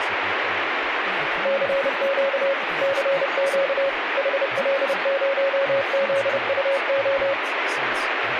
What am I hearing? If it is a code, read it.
Morse code, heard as a keyed tone, machine-sent, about 30 wpm, 550 Hz, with radio static and speech in English. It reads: CQ CQ HL0ZUO